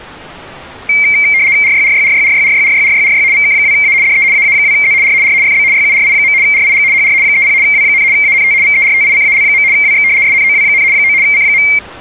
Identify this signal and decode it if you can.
RTTY (75 baud, 170 Hz shift), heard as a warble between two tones, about 2200 Hz centre. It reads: RYRYRYRYRYRYRYRY VK2A DE AA2Z R R FB YURI. RIG HR 30 W, ANT VERTICAL. WX SNOW, 9 C.